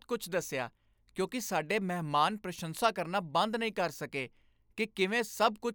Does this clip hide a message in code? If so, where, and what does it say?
No, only speech in Punjabi.